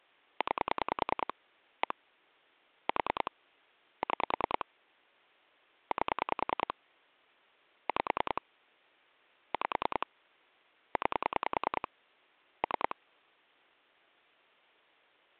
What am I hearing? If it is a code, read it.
Pulse dialling, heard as clicks on a phone line, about 10 pulses a second. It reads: 9 1 4 6 8 5 5 9 3